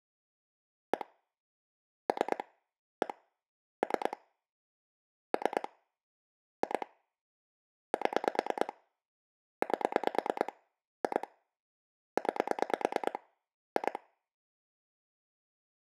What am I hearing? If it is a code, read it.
Pulse dialling, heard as clicks on a phone line, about 9 pulses a second. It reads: 1 3 1 3 3 2 7 8 2 9 2